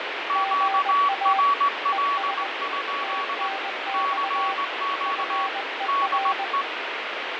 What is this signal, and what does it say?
Morse code, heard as two keyed tones, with heavy radio static and fading. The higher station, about 19 wpm, 1120 Hz: QRL? CQ DE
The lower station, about 20 wpm, 780 Hz: GA ES TNX FER